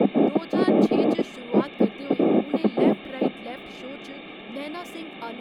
Bursts of noise, with phone line noise and speech in Dogri. There is no code.